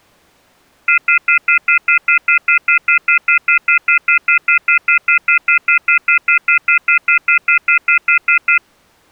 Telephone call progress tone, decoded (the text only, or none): off-hook warning tone